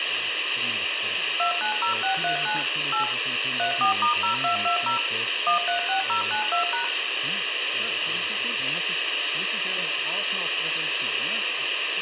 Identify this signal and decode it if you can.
DTMF, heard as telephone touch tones, dialled by machine, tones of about 120 ms, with radio hiss, room echo and speech in German. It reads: 290639 8 34*0220 136092#